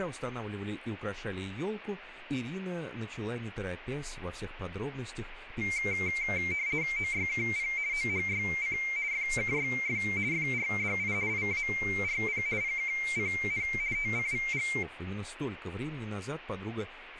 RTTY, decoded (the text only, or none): OYKP OHYC FKYF FRDI IARP PKCN TCVG